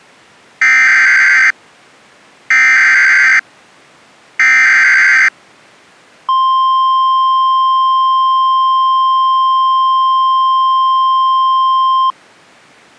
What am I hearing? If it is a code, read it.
Emergency Alert System (SAME) tones (header bursts, then the 1050 Hz attention tone), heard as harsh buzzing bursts, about 520.83 baud.